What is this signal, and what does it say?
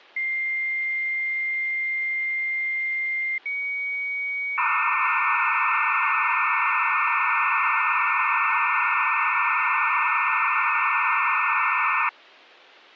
Dial-up modem handshake (low-speed, two carriers), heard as two whistles, then hiss.